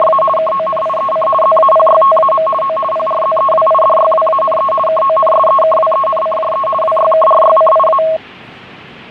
RTTY (50 baud, 450 Hz shift), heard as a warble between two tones, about 860 Hz centre, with the noise of a subway station. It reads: … KONIEC ZAPYTAM O PRZEWIDYWANE KONSEKWENCJE WYKRYCIA